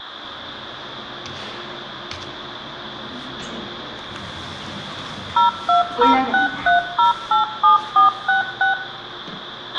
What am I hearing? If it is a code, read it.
DTMF, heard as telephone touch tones, dialled by machine, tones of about 130 ms, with a squelch burst at the end, room echo and the noise inside a lift. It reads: 02063087466